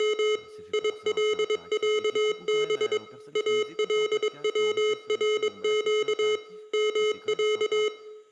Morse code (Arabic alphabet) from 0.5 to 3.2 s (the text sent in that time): يلعب